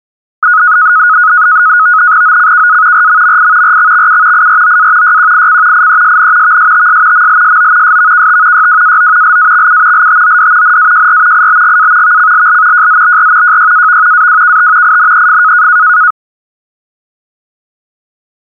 NAVTEX (SITOR-B), 100 baud, 170 Hz shift, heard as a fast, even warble, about 1360 Hz centre. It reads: OCKA RMMI RXXU IROA YQIC IESN VSTS MLSO SVKT YWAO LAXU LTOD NAJR IBGA VCLL JZBR JYAV AWKT INEF